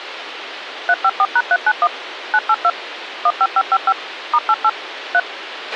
DTMF, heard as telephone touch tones, dialled by machine, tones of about 50 ms, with radio hiss and a squelch burst at the end. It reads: 354#391 982 15555 *88 3